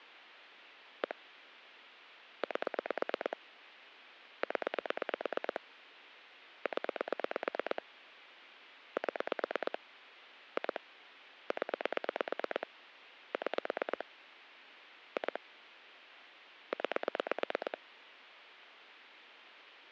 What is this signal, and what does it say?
Pulse dialling, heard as clicks on a phone line, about 8 pulses a second. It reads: 1 8 0 0 7 2 0 6 2 9